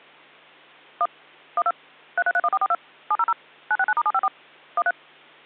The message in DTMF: 1 12 3331442 700 969*754 13

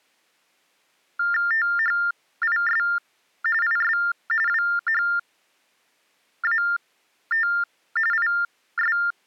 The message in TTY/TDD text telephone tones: THIS IS WHAT IS

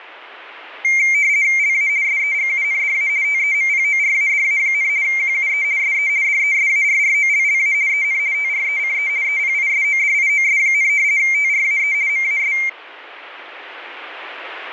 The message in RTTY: LA SEGUNDA TEMPORADA, QUE SE DESARROLLA EN TRECE EPISODIOS, TRAE MAS

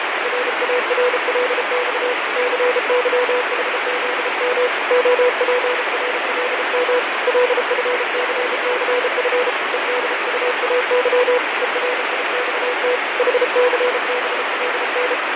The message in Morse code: RARLX CYHZM OPRLM LFCCF EDUAY ERIXT HCBLN

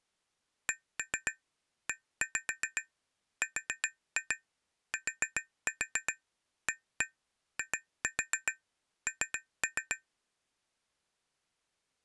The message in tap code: CERTAIN

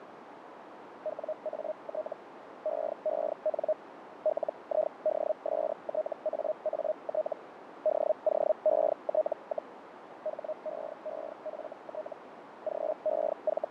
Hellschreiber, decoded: WAT EEN LIDSTAAT DOET, HEEFT …

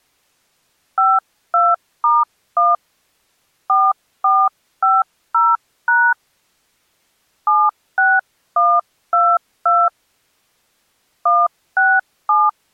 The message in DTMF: 52*1 4450# 76122 167

